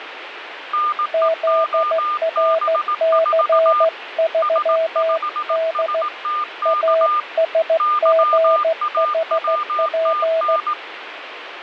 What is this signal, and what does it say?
Morse code, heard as two keyed tones, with radio static. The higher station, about 18 wpm, 1210 Hz: NEOB4 S5STK YAWTN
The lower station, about 15 wpm, 650 Hz: ZRC3D ASGHP